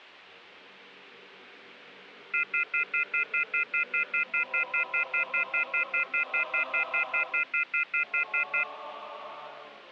Telephone call progress tone (North American plan), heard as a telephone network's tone, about 1400, 2050, 2450, 2600 Hz, 0.1 s on and 0.1 s off. Off-hook warning tone.